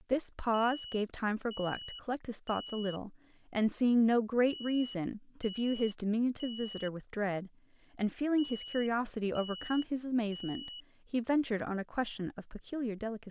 Alarm pattern, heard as an alarm's beeps, played three times, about 2950 Hz, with speech in English. Temporal three. Smoke or fire, evacuate.